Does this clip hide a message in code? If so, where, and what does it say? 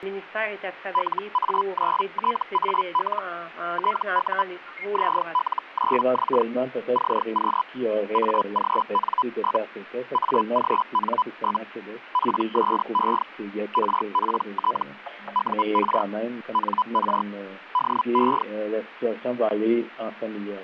Yes: Hellschreiber (Feld-Hell, 122.5 baud) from 0.9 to 18.4 s, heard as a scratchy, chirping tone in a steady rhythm, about 1000 Hz. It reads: LA9TAL TU ZL9X CQ AGN? AGN? PSE RPT UR NR DE